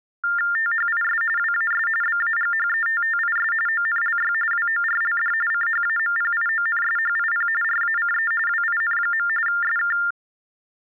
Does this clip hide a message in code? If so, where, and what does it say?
Yes: TTY/TDD text telephone tones (45.45 baud Baudot) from 0.2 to 10.1 s, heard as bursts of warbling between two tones, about 400 Hz shift, 1600 Hz centre. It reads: THIS WAS BAGHETTIS ONLY WORLD CHAMPIONSHIP RACE WIN. SK